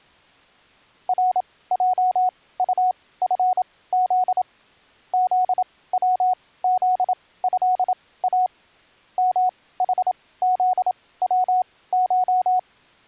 Morse code (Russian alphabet), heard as a keyed tone, machine-sent, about 27 wpm, spaced as for 18 wpm, 740 Hz. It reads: РЙУФЗ ЗВЗЭА МХЗВШ